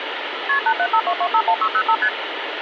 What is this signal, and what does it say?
Multi-frequency trunk signalling (R1, as on North American trunks), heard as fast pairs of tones, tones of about 70 ms, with phone line noise. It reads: KP 8752251605 ST